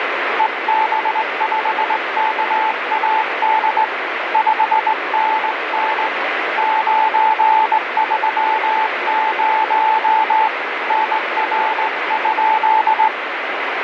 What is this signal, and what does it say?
Morse code, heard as a keyed tone, hand-sent with a straight key, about 19 wpm, 880 Hz, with heavy radio static. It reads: EB5KAD 5NN 930 NR?